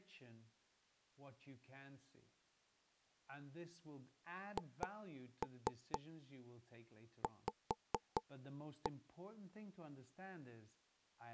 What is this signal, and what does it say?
Tap code, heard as taps on a table, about 4 knocks a second, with speech in English. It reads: HV